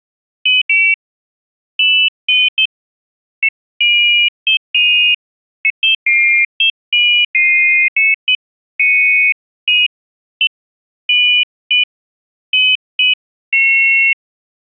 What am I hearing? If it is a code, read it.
Pairs of high tones at irregular times. There is no code.